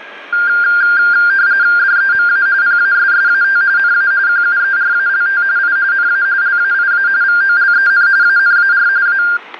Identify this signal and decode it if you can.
RTTY (45.45 baud, 170 Hz shift), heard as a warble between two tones, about 1500 Hz centre, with static crashes and the noise of a subway station. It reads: DEMA PASSAT NA QUERALT I NA LAIA VOLEN ANAR A